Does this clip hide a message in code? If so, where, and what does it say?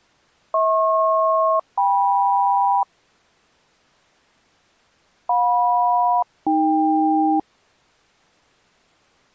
Yes: aircraft SELCAL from 0.5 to 7.4 s, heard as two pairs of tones. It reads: HP-KM JM-AK